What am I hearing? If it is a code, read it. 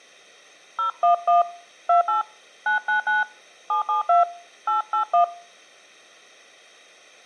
DTMF, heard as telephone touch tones, dialled by hand, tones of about 120 ms. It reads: 011 28 999 772 881